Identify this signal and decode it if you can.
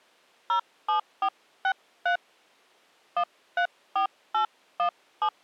DTMF, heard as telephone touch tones, dialled by hand, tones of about 90 ms. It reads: 07463 134817